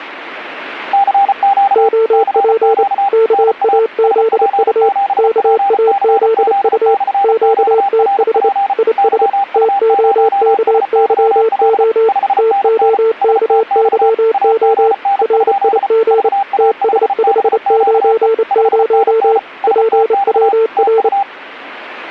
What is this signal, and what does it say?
Morse code, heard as two keyed tones. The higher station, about 34 wpm, 800 Hz: CQ CQ NA SP7PCZ/QRP YU0SYL 5NN STX AGN? VA5BQE 5NN STX TU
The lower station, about 28 wpm, 450 Hz: OP KAZU KAZU QTH IS TOKYO TOKYO RIG TS590 PWR